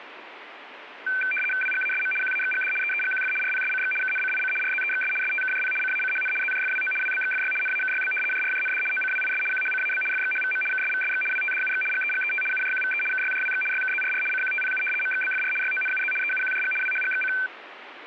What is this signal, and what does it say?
RTTY (75 baud, 850 Hz shift), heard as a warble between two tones, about 1950 Hz centre, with radio static. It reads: WGASM QAXGD EEGQF RPSCX KNCIC RZEXS STKJP CACHN ZJFWO WBXFY NAKYB JRJND OCWIS QHCAB FXHVM KSVSX WTDUX GEGET UJQVE KYJWX YKZRR CQTPU MXBFR YONUZ EUQJG WHGXC